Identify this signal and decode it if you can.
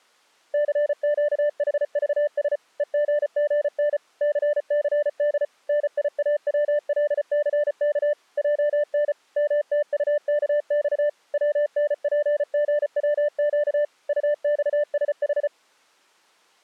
Morse code, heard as a keyed tone, machine-sent, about 34 wpm, 590 Hz. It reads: CQHVS EGGN CCD NIAWLCK JN MTUKX WNPGWQ UXSH